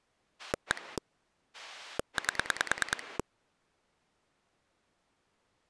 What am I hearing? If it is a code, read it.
Pulse dialling, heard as a rotary dial, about 9 pulses a second. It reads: 1 8